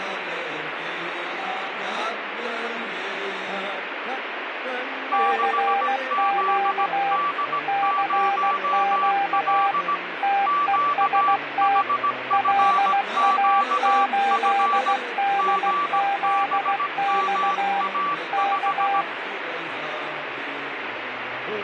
Morse code, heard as two keyed tones, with radio static. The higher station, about 17 wpm, 1160 Hz: 6ZD0L QHFQF GBMA5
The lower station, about 16 wpm, 800 Hz: CQ CQ TEST LA8DZX K